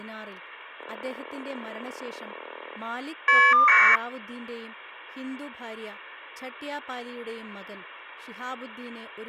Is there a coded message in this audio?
Yes: caller ID data burst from 0.8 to 4.0 s, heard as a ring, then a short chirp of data, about 1200 baud, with speech in Malayalam.